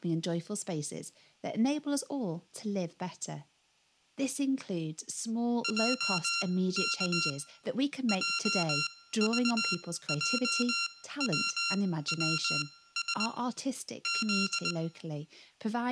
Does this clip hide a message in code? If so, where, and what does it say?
Yes: Morse code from 5.6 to 14.8 s, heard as electronic beeps, machine-sent, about 20 wpm, spaced as for 15 wpm, 1380 Hz, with room echo and speech in English. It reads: JK JVJWWS Z